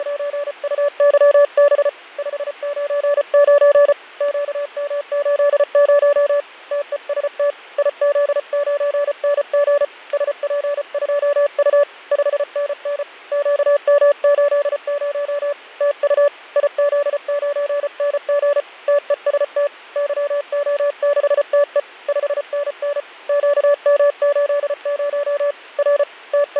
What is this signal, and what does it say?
Morse code, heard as a keyed tone, hand-sent with a paddle, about 34 wpm, 580 Hz, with fading. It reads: … 599 QM80 TEST IZ9NG SP2U 5NN QM80 TU IZ9NG TEST YO6TE 5NN QM80 R …